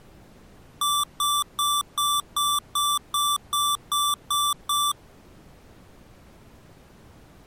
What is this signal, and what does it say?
Beep code, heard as beeps from a small speaker, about 1170 Hz. 11 short. In AMI BIOS tables: cache memory error.